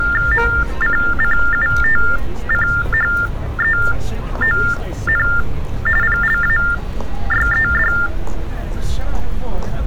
TTY/TDD text telephone tones (45.45 baud Baudot), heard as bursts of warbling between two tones, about 400 Hz shift, 1600 Hz centre, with street noise. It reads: MCCUTCHEON PLAYED